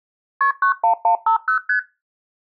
Multi-frequency trunk signalling (R1, as on North American trunks), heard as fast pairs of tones, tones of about 100 ms. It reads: KP 91150 ST